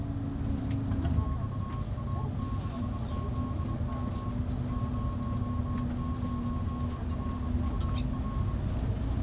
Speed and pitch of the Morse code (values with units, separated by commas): 24 wpm, 1090 Hz